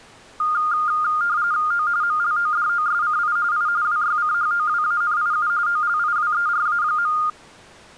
RTTY (45.45 baud, 170 Hz shift), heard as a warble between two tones, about 1320 Hz centre. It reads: O MLODOSCI I WYCHOWANIU OLIWERA.